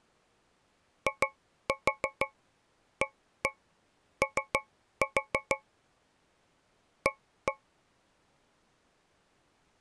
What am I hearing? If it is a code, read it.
Tap code, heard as taps on a metal pipe, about 6 knocks a second. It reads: IAO A